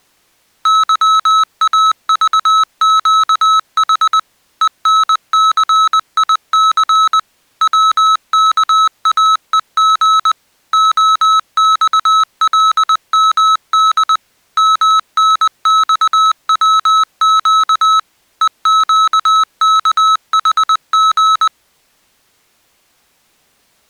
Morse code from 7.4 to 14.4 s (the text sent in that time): WKAEG OXLMD